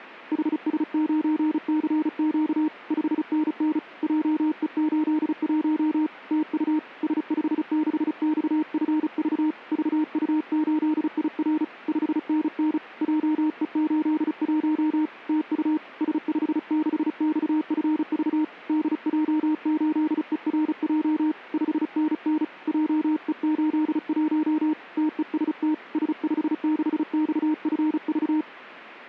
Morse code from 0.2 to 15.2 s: HS9CQ 5NN JE81 TU S56XFV VU8IR 5NN JE81

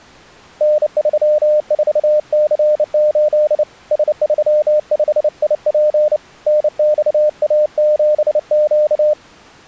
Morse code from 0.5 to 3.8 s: N34C8

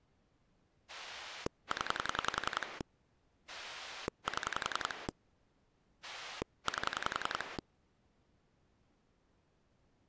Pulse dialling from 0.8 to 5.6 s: 0 7

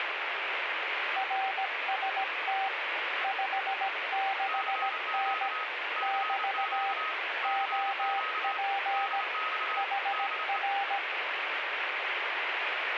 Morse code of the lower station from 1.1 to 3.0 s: RST

